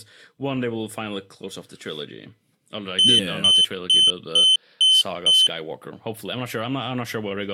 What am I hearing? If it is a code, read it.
Beep code, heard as a piezo beeper, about 3050 Hz, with speech in English. 6 short. In AMI BIOS tables: keyboard controller gate A20 failure; in Dell tables: video card failure.